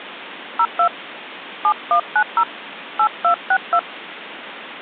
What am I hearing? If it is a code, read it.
DTMF, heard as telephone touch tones, dialled by hand, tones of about 80 ms, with phone line noise. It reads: 02 7190 8262